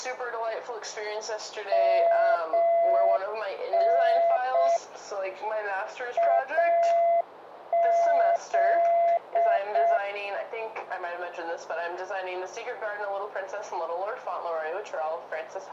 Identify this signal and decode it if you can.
Morse code (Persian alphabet), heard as a keyed tone, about 6 wpm, 680 Hz. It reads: من از